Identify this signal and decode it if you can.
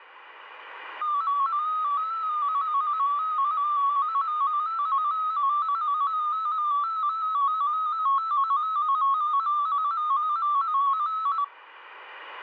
Multi-tone FSK (Olivia or MFSK type), about 250 Hz wide, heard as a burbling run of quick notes, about 15.625 baud.